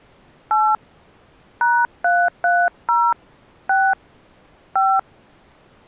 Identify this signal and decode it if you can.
DTMF, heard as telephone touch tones, dialled by hand, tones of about 240 ms. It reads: 8 #330 6 5